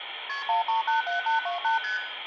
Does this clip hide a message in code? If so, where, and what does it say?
Yes: multi-frequency trunk signalling (R1, as on North American trunks) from 0.3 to 2.0 s, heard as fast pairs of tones, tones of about 130 ms, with phone line noise and room echo. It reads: KP 1387828 ST